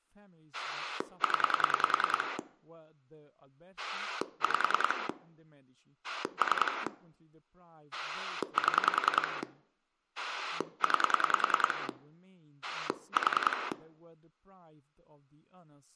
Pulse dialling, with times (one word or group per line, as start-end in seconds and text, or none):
0.5-2.4 0
3.8-5.1 5
6.0-6.9 3
7.9-9.4 7
10.2-11.9 9
12.6-13.7 4